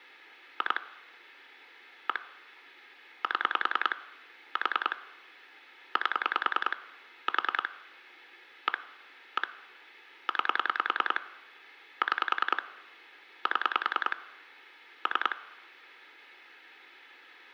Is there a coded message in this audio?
Yes: pulse dialling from 0.6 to 15.3 s, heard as clicks on a phone line, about 10 pulses a second. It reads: 2 1 7 4 8 4 1 1 9 6 7 3